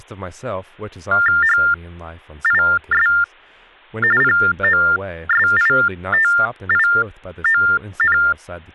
TTY/TDD text telephone tones (45.45 baud Baudot), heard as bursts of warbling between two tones, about 400 Hz shift, 1600 Hz centre, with speech in English. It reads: HIS POSITION